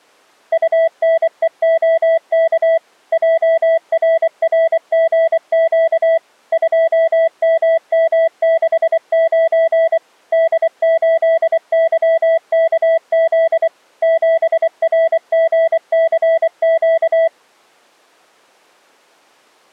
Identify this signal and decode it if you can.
Morse code, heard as a keyed tone, machine-sent, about 24 wpm, 660 Hz. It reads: UNEOK JRRGQ 2MM69 D8YKZ 7RGCQ